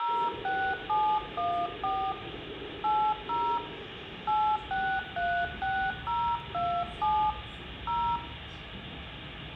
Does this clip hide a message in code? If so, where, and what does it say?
Yes: DTMF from 0.0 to 8.2 s, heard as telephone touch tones, dialled by hand, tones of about 290 ms, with phone line noise, room echo and the noise inside a subway train. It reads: 06714 80 8636027 0